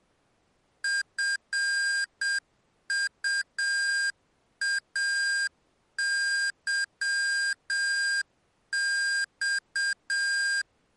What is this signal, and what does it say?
Morse code, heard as electronic beeps, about 7 wpm, 1600 Hz. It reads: FUAYX